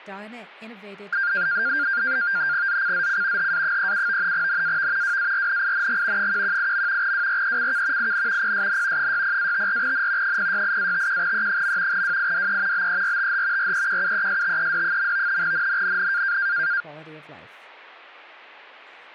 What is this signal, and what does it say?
NAVTEX (SITOR-B), 100 baud, 170 Hz shift, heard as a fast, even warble, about 1500 Hz centre, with speech in English. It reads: ZCZC HA37 NAV WARNING 118. WRECK IN PSN 60-54N 068-51E. WIDE BERTH REQUESTED. NNNN